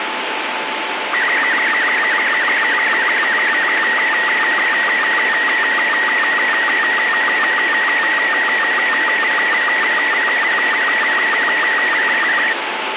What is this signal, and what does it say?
SSTV (slow-scan television), Robot 36, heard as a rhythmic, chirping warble, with heavy radio static.